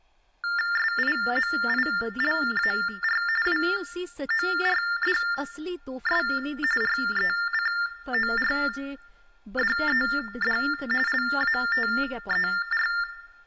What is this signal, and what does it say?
TTY/TDD text telephone tones (45.45 baud Baudot), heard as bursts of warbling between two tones, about 400 Hz shift, 1600 Hz centre, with room echo and speech in Dogri. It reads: SIMILAR WORDS RECORDED LATER